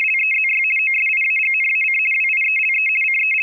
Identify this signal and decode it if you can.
RTTY (50 baud, 450 Hz shift), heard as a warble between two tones, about 2350 Hz centre. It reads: … OSIAGNAC WIELE …